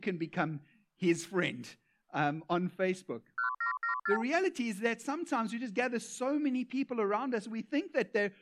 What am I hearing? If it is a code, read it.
Multi-frequency trunk signalling (R2, with the far end's replies), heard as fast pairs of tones, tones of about 110 ms. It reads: 1774